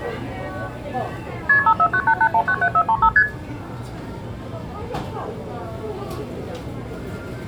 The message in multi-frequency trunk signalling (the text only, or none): KP 54988197435 ST